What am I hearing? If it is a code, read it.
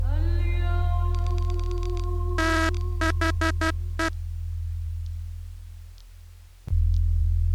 Morse code, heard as a buzzer, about 12 wpm. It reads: THE